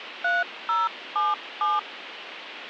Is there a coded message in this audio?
Yes: DTMF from 0.2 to 1.8 s, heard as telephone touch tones, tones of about 190 ms, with phone line noise. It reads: 3077